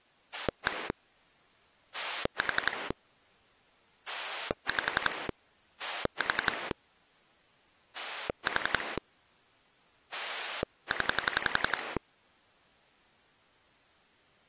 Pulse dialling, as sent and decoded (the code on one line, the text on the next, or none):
1 / 4 / 5 / 4 / 4 / 10
1 4 5 4 4 0